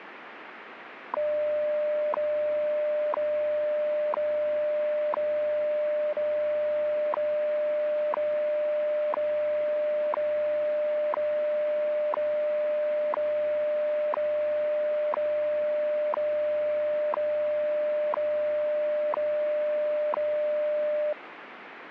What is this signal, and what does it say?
Radio time signal (WWV, Colorado), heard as ticks, one a second, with radio static.